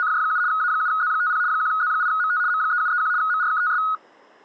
RTTY (75 baud, 170 Hz shift), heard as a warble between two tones, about 1360 Hz centre. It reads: … A7Z50 1Z8MT M3731 MRKTS